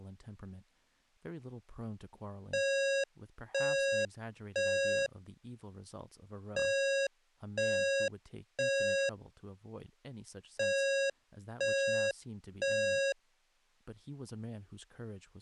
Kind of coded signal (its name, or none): alarm pattern